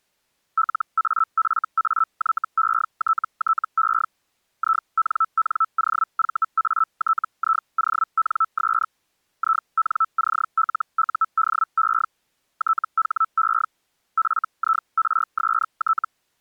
Hellschreiber (Feld-Hell, 122.5 baud), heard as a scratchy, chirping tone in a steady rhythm, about 1320 Hz. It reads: LAFAYETTE INNOVATIONS INCLUDE THE FIRST